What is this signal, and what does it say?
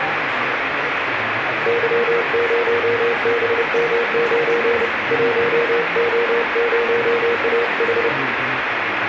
Morse code, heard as a keyed tone, hand-sent with a paddle, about 30 wpm, 470 Hz, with radio static, room echo and the noise of a crowd indoors. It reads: Y0BM9 1O0AH